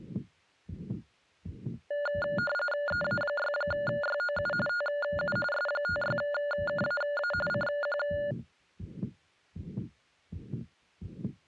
RTTY (45.45 baud, 850 Hz shift), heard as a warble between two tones, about 1010 Hz centre. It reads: EA6YOU TU S56KAA CQ